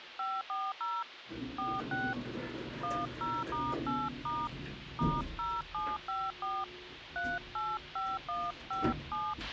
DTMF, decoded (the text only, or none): 540 46 10*8* *0754 385157